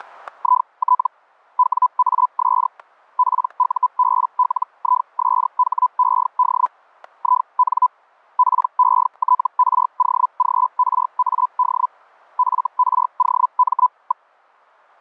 Hellschreiber (Feld-Hell, 122.5 baud), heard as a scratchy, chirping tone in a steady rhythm, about 1000 Hz, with static crashes. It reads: IT WAS PUBLISHED IN PETROGRAD FROM.